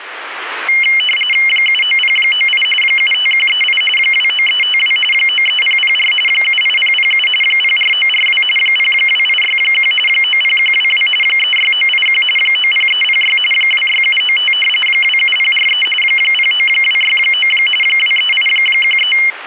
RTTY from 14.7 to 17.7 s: 27043 09269

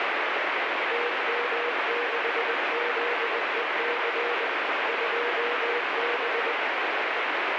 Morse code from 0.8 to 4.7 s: TM6ZEC

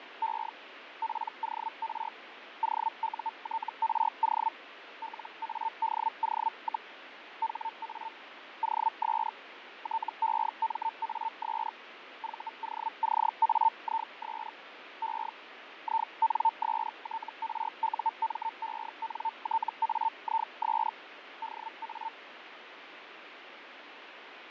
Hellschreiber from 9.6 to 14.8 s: TEMAS VOCAIS

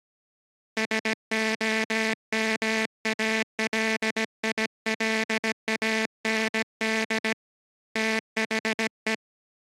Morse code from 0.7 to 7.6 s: SOMALILAND

